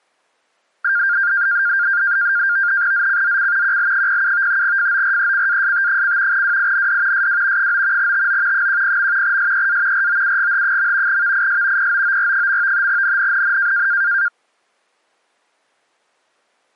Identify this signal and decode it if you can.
NAVTEX (SITOR-B), 100 baud, 170 Hz shift, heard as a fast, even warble, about 1500 Hz centre. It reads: ZCZC QL07 FORECAST: WIND SW 9 TO 10. SEA ROUGH. VIS POOR. NNNN